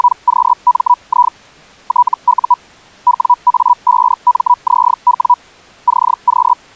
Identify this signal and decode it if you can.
Hellschreiber (Feld-Hell, 122.5 baud), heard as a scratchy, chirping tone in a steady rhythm, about 980 Hz. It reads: … TU WA5MZW CQ